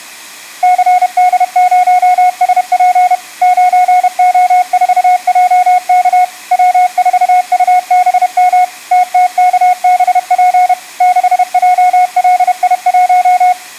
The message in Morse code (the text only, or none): CD0SP 9O4JK W4UBM TTKBP 6JLI1